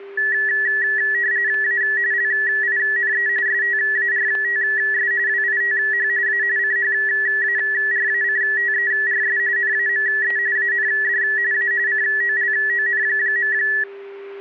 RTTY (45.45 baud, 170 Hz shift), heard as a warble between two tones, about 1800 Hz centre, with static crashes and a steady whistle near 400 Hz. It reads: A LINE STARTS WITH A CHARACTERS NAME AND A COLON.